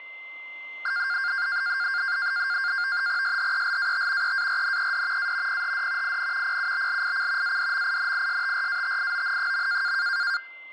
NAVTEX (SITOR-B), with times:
3.2-4.3 SHELAT
4.2-5.3 EARNED
5.2-5.6 A
5.5-6.2 PHD
6.0-6.6 IN
6.4-7.6 PUBLIC
7.4-9.9 ADMINISTRATION.

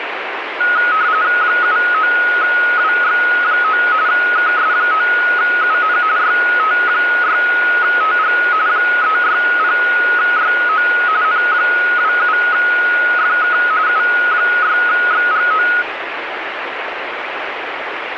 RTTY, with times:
1.4-3.8 79WX9
4.1-6.0 KS9UN
6.2-8.4 YT6TG
8.7-10.9 360YO
11.2-13.6 N27FK
13.9-15.7 U6XGO

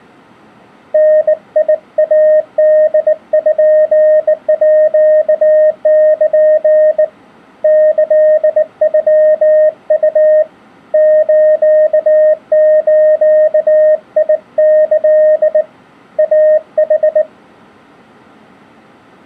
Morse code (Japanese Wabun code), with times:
0.9-7.0 ダイポール
7.6-10.4 キノウ
10.9-15.6 スズキ
16.2-17.2 イヌ

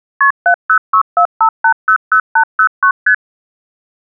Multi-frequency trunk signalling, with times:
0.2-0.3 KP
0.5-2.9 70645800809
3.1-3.1 ST

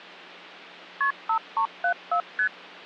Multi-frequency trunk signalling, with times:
1.0-1.1 KP
1.3-2.2 5374
2.4-2.5 ST

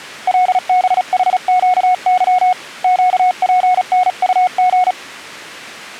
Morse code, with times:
0.3-2.5 LBHQY
2.8-4.9 QPNUG

